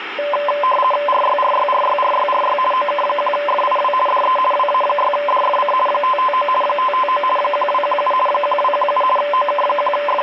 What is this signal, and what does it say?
RTTY (50 baud, 450 Hz shift), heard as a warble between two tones, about 810 Hz centre, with radio static. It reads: RYRYRYRYRY OK1FIW DE WA6DFC 559 559 1217 1217 …